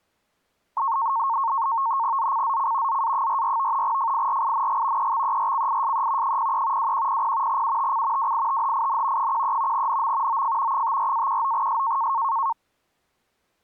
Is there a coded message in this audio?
Yes: NAVTEX (SITOR-B), 100 baud, 170 Hz shift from 0.8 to 12.5 s, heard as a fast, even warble, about 1000 Hz centre. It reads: ZCZC ZA44 FIRING EXERCISE 03 2100 UTC WITHIN 13 NM OF 54-19S